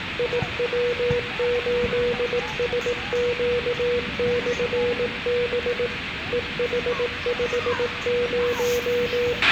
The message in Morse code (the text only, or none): IW8SQ/B EH50